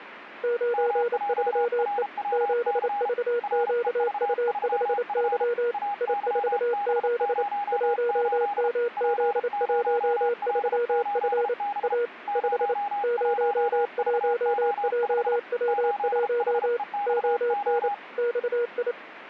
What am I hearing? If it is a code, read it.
Morse code, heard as two keyed tones. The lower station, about 28 wpm, 480 Hz: 93E 7VQU5Y I47 1MZ13F A 5 01JW1 ON XI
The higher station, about 33 wpm, 820 Hz: MJRWC REV3F AYB08 P0L8B 01VO5 8HEXO